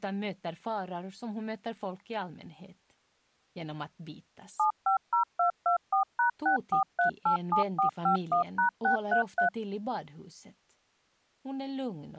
DTMF, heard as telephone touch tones, dialled by machine, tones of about 110 ms. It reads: 750224#64387451#633